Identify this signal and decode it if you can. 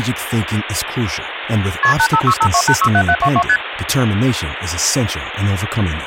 Multi-frequency trunk signalling (R1, as on North American trunks), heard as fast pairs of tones, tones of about 70 ms, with phone line noise and speech in English. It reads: KP 85652867722 ST